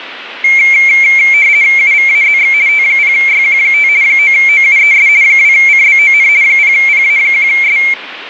RTTY (50 baud, 170 Hz shift), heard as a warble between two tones, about 2250 Hz centre, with radio static. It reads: UVAZX T0YQ5 9OUES 2CBON 0PA1S